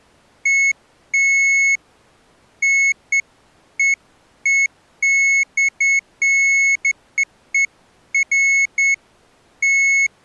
Beeps of irregular length. There is no code.